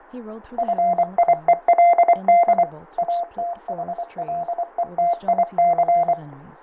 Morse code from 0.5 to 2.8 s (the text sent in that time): FIELD